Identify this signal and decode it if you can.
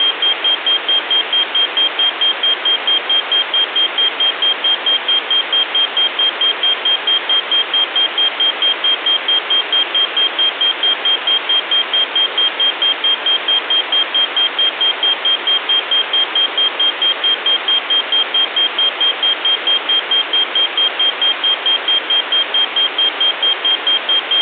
Evenly repeated beeps. There is no code.